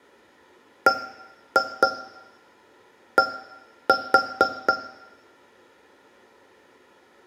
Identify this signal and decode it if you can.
Tap code, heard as taps on a metal pipe, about 4 knocks a second, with room echo. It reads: BD